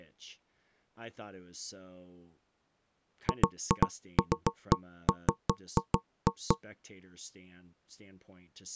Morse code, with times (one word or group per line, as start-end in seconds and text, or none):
none